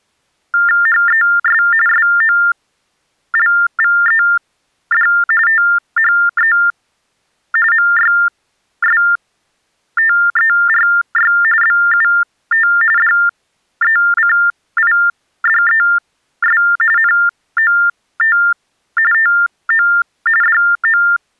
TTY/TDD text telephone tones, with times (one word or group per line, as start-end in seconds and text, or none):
0.9-1.6 HES
1.9-5.1 SOLVED
5.5-6.5 THE
7.7-11.3 MYSTERY
11.6-12.7 BUT
13.0-16.6 DECIDES
17.0-18.4 NOT
19.1-19.9 TO
20.4-21.0 DO